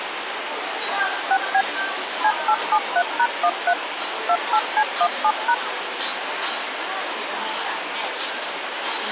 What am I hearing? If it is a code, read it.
DTMF, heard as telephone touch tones, dialled by machine, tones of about 60 ms, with phone line noise and the noise of a restaurant. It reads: 6B C873#13 28C17#